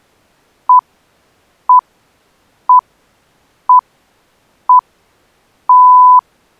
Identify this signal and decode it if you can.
Radio time signal (six pips, as the Greenwich Time Signal), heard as pips.